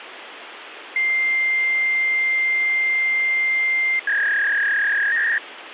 Fax machine handshake, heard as a long tone and a warble, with phone line noise.